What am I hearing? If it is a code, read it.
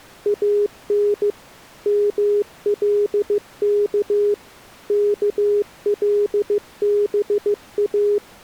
Morse code (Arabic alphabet), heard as a keyed tone, machine-sent, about 15 wpm, 410 Hz. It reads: ان ملك كلبا